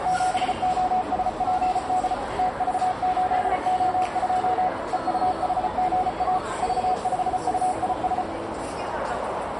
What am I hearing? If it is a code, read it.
Morse code, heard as a keyed tone, machine-sent, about 34 wpm, 740 Hz, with radio static, a narrow filter and the noise of a crowd indoors. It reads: 7OSPD TV8O2 EUHGA V5UIS